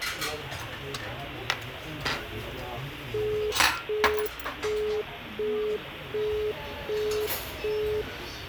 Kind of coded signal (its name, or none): telephone call progress tone